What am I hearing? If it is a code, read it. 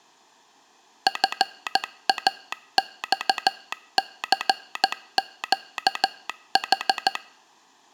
Morse code, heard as a telegraph sounder, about 14 wpm. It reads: FAXCQH